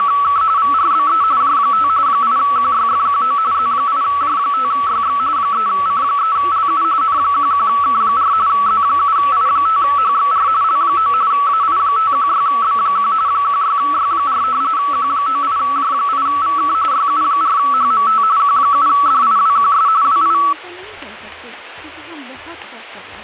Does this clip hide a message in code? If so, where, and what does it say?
Yes: RTTY (45.45 baud, 170 Hz shift) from 0.0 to 20.5 s, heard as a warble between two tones, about 1220 Hz centre. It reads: … VRBE J5 8QYFQO Z8J5YX 3C3LU N11K4 Z7I5HXR L9 AI516B1 16Y4 Q98J8VK YU4HMT Q7DIWQS WI